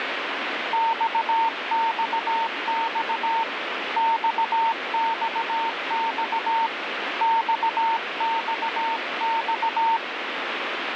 Morse code, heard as a keyed tone, hand-sent with a paddle, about 17 wpm, 910 Hz, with heavy radio static. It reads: XXX XXX XXX